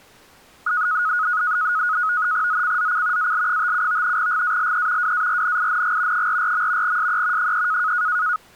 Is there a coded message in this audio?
Yes: NAVTEX (SITOR-B), 100 baud, 170 Hz shift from 0.7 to 8.4 s, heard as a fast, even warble, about 1360 Hz centre. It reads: ZCZC AL57 GALE WARNING 44. SE 3